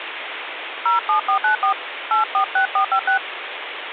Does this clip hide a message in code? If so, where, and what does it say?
Yes: DTMF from 0.9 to 3.2 s, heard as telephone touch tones, dialled by hand, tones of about 110 ms, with phone line noise. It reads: 07494 846456